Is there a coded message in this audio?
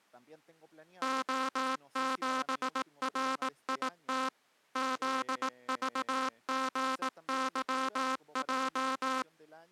Yes: Morse code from 1.0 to 9.3 s, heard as a buzzer, machine-sent, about 18 wpm, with speech in Spanish. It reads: O7RIT ZVGYJ